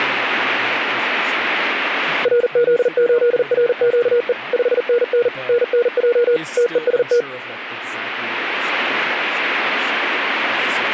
Morse code, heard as a keyed tone, machine-sent, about 40 wpm, 480 Hz, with radio static and speech in English. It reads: RZ8RQE 5NN NNJ TEST